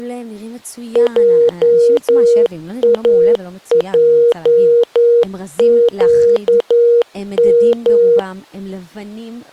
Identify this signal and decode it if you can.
Morse code, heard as a keyed tone, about 11 wpm, 470 Hz, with speech in Hebrew. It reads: JAJQM